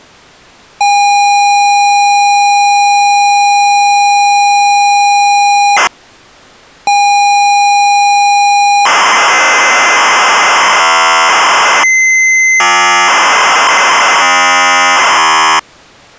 ZX Spectrum tape loading, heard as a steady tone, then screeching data.